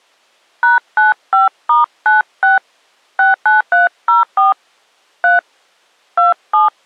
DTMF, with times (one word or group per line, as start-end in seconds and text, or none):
0.6-2.6 #95*96
3.2-4.5 69304
5.2-5.4 3
6.2-6.7 27